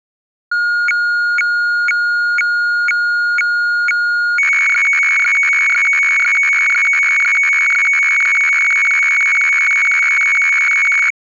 Weather fax (radiofax), 120 lines a minute, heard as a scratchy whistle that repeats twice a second.